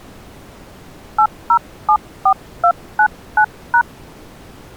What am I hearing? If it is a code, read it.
DTMF, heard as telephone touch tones, dialled by hand, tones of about 80 ms. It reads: 8074299#